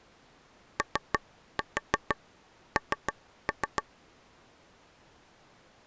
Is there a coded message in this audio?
Yes: tap code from 0.8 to 3.8 s, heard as taps on a table, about 6 knocks a second. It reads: ON